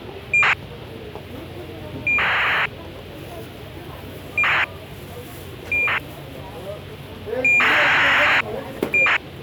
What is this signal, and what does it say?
ACARS aircraft data, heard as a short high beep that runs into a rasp, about 2400 baud, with the noise of a crowd indoors.